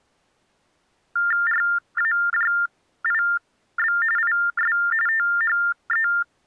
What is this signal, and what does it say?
TTY/TDD text telephone tones (45.45 baud Baudot), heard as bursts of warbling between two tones, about 400 Hz shift, 1600 Hz centre. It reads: RAJIB IS THE